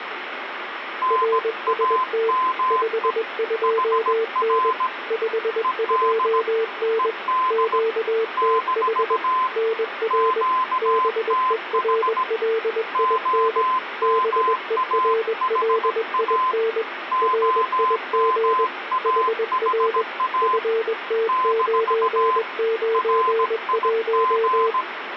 Morse code, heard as two keyed tones, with radio static. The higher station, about 17 wpm, 1030 Hz: NAME HR ED ED - QTH OMAHA OMAHA - RIG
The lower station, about 21 wpm, 450 Hz: RST 52N 52N QTH NR BERLIN BERLIN RIG HR FT991